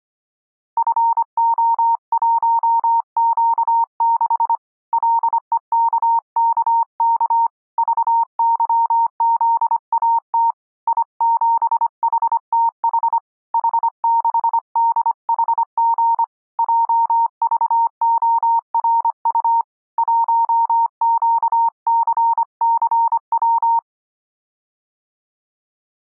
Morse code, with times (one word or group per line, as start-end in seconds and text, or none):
0.8-4.5 FO1Q6
4.9-7.5 LEKKK
7.8-10.5 VYZAT
10.9-13.2 I7HTH
13.5-16.2 H6DHG
16.6-19.6 JVORU
20.0-23.8 1QCCW